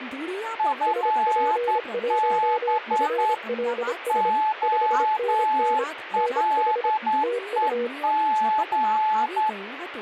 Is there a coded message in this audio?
Yes: Morse code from 0.5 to 9.6 s, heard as two keyed tones, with radio static and speech in Gujarati. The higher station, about 10 wpm, 860 Hz: FB OLEG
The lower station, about 26 wpm, 480 Hz: SP1FLS 5NN NH TU